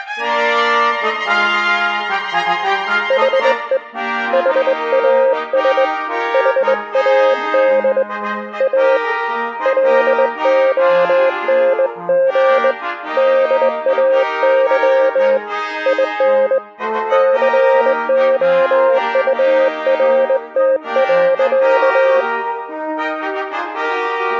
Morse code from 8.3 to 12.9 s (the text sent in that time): A LONG